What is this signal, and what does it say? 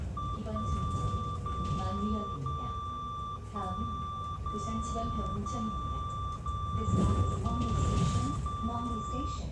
Radio time signal (DCF77), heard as a tone whose level steps once a second, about 1170 Hz, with the noise inside a bus. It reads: 1 0 0 1 0 0 0 0 0